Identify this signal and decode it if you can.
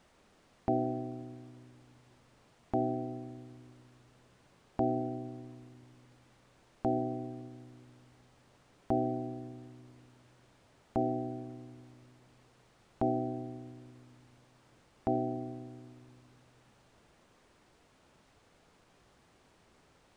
Clock strike, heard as a bell. 8. Eight o'clock.